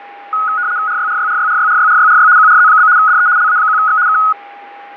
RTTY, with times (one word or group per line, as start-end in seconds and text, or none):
0.9-2.3 RYRYRYRYRYRYRY
2.4-2.9 QRZ?
3.0-3.3 DE
3.4-4.0 LA1X
4.1-4.2 K